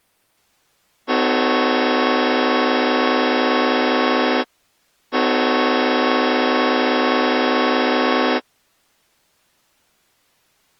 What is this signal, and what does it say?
Train horn signal, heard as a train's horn. 2 long. On North American railways: brakes released, proceed.